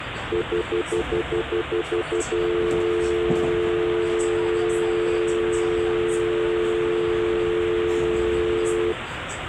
Telephone call progress tone (North American plan), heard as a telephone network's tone, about 350, 440 Hz, 0.1 s on and 0.1 s off, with phone line noise and the noise inside a subway train. Stutter dial tone.